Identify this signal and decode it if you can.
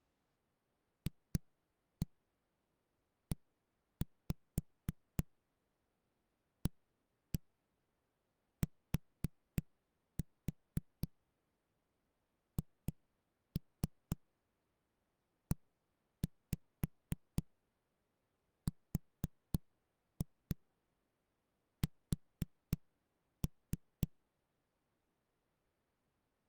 Tap code, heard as knocks on a wall, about 3 knocks a second. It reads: FEATHERS